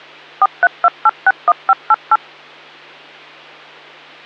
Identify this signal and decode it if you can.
DTMF, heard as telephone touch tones, dialled by machine, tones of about 40 ms, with hum. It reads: 432861588